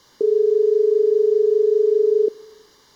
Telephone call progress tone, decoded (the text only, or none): dial tone